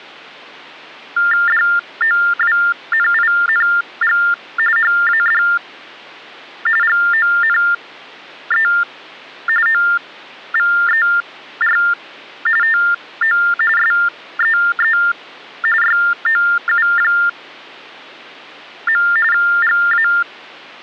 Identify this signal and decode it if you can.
TTY/TDD text telephone tones (45.45 baud Baudot), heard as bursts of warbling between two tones, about 400 Hz shift, 1600 Hz centre. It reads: DOWNING HAD GONE OVER TO SEE YOU. GA